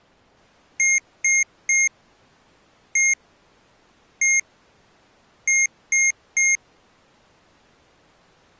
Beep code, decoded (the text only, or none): 3-1-1-3